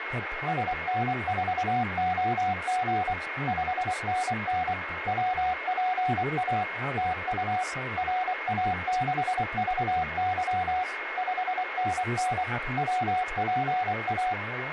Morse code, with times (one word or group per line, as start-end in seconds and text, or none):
0.5-3.1 SN4OG
3.5-4.7 5NN
5.1-6.6 WPA
7.0-7.6 TU
8.0-10.8 RA6VY
11.2-12.4 5NN
12.8-14.3 WPA